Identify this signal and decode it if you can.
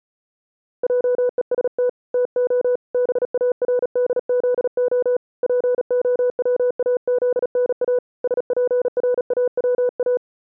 Morse code, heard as a keyed tone, hand-sent with a paddle, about 37 wpm, 490 Hz. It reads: JEST TO BARDZO POWAZNA SPRAWA